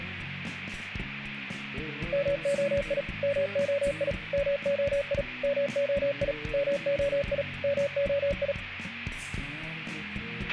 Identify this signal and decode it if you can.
Morse code, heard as a keyed tone, machine-sent, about 37 wpm, 560 Hz, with a squelch burst at the end. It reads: MOI MOI MOI MOI MOI MOI